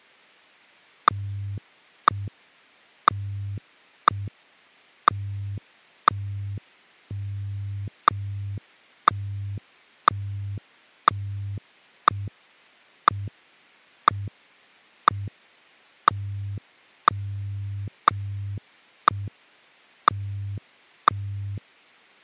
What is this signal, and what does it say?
Radio time signal (WWVH, Hawaii), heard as ticks, one a second.